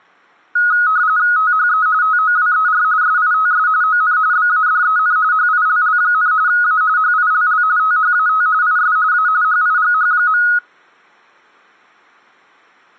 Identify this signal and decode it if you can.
RTTY (45.45 baud, 170 Hz shift), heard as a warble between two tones, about 1360 Hz centre. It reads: THE TOWER SITS ON BADEN HILL, A HILL THAT IS A HIGH.